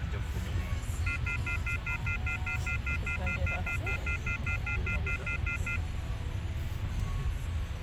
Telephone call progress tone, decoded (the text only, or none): off-hook warning tone